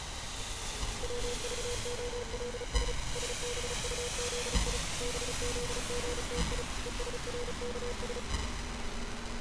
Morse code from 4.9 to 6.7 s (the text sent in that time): BZGTI